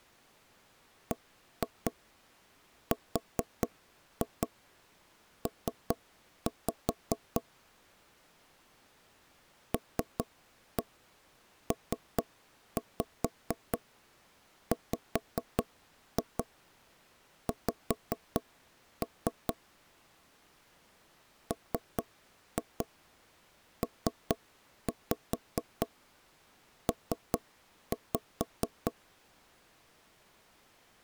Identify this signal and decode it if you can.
Tap code, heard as knocks on wood, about 4 knocks a second. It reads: BRP LPWX MPP